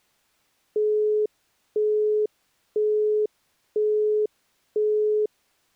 Telephone call progress tone (single-tone plan, as in Europe, Japan and elsewhere), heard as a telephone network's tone, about 420 Hz, 0.5 s on and 0.5 s off. Busy tone.